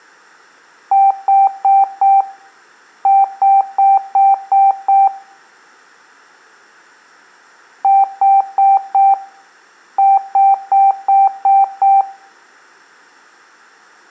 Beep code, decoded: 4-6

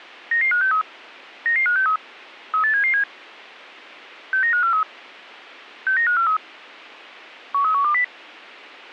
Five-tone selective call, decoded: 99563 99563 38777 69543 69543 13120

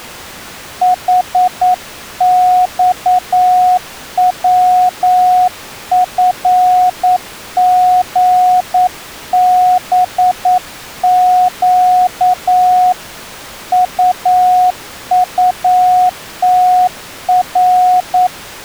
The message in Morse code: HXWFGBQ UUTR

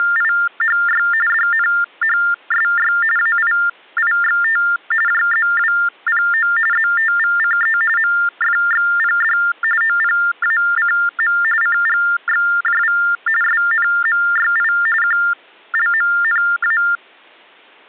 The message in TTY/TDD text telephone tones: … DNHSY AIIXT JZWPO ZTVCE MFXPD OPACM CGXJV SNMYI QLMNA

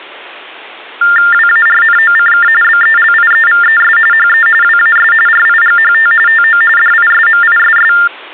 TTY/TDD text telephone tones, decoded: WARNOCK BELIEVES HE WAS RIGHT TO DISMISS

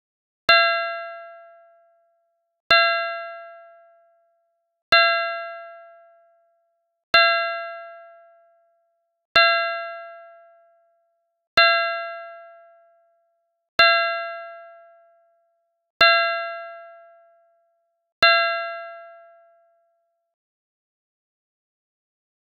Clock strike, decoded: 9

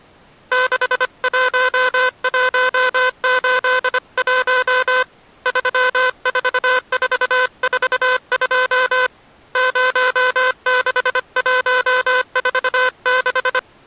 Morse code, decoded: 61181 34442 06146

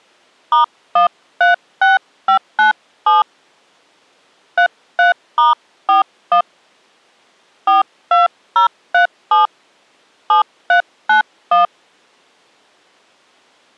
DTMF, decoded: *136597 33*41 42037 7391

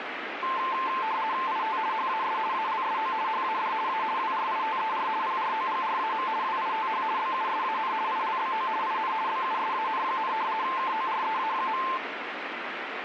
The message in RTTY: IT HAS ALSO HAD A WRITER PROGRAM WITH BUSAN ILBO IN BUSAN, KOREA.

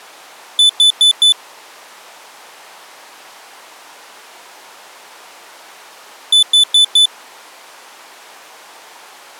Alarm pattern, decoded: temporal four

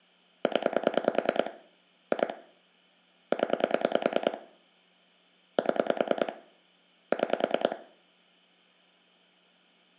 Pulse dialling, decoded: 0 2 0 7 6

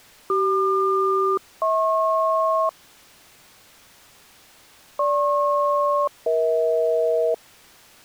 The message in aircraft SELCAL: CQ-HP GP-EH

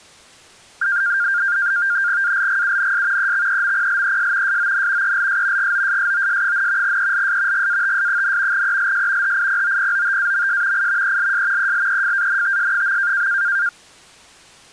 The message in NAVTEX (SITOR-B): ALGUNS EXEMPLES SON ELS GOSSOS, ELS GATS, ELS HIPOPOTAMS I ELS ELEFANTS.

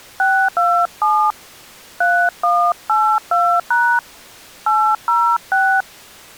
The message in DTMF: 627 3182# 806

